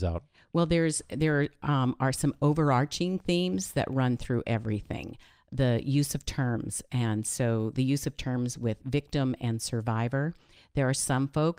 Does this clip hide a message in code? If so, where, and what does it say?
No, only speech in English.